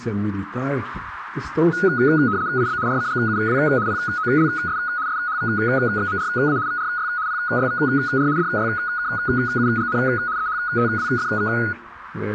RTTY (75 baud, 170 Hz shift), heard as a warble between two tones, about 1360 Hz centre, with radio static. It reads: IB RCGUW POLS SHVXMRA VRY PYVR DYKUGN EHTWFV